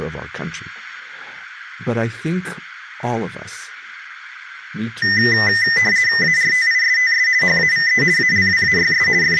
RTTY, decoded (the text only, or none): ARTISTS HAVE ALWAYS …